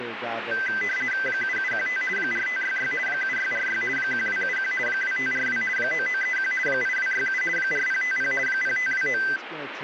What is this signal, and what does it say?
RTTY (50 baud, 450 Hz shift), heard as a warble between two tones, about 1800 Hz centre, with radio static and speech in English. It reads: 7715 4566 7646 1271 2542 9931 8267 4050 0529